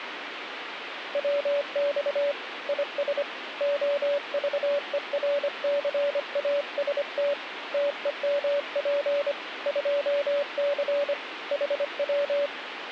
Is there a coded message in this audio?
Yes: Morse code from 1.1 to 12.5 s, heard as a keyed tone, hand-sent with a paddle, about 25 wpm, 570 Hz, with radio static. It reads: WX IS OVERCAST TEMP 2C HW